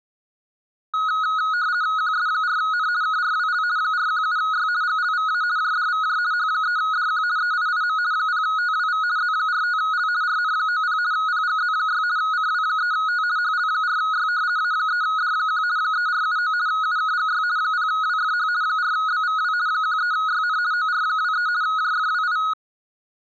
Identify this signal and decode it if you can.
RTTY (50 baud, 170 Hz shift), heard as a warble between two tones, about 1360 Hz centre. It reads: QS4N KRWL 417Y GLVA JDVJ H3DQ EIIM 0TWV Z45L RN90 PGZ6 CW3T HL4Y A3D1 3479 UKGY 0WFH 4BVW 13YN OR23 JFWI